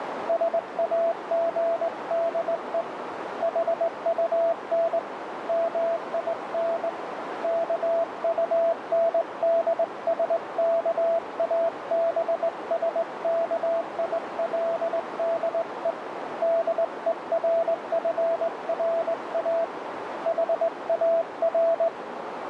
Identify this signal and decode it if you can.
Morse code, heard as a keyed tone, hand-sent with a straight key, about 20 wpm, 670 Hz, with radio static and a narrow filter. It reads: SAGDE HUN MIN KUNDSKABSKILDE DERFRA HAR